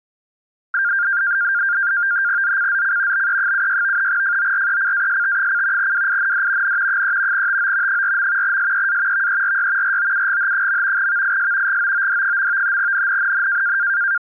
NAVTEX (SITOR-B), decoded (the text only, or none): ZCZC BE76 FORECAST: WIND N 3 TO 4. SEA VERY ROUGH. VIS GOOD. NNNN